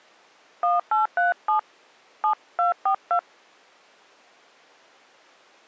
DTMF, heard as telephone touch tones, dialled by hand, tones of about 120 ms. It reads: 1837 7242